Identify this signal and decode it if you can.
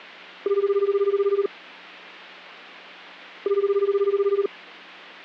Telephone call progress tone (Japanese plan), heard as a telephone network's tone, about 380, 400, 420 Hz, 1 s on and 2 s off. Ringback tone.